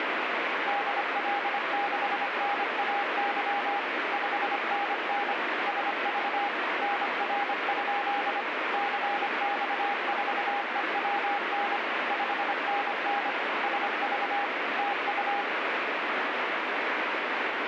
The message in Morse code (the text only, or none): DL6NAY 5NN SV NR? CX4EWN 5NN SV TU